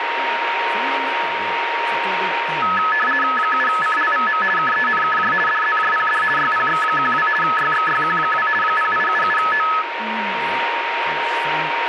RTTY (50 baud, 450 Hz shift), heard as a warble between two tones, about 1500 Hz centre, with radio static, a steady whistle near 930 Hz and speech in Japanese. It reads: 7CLVM KENKJ DZJPD YPX12 YXYQ2 0877O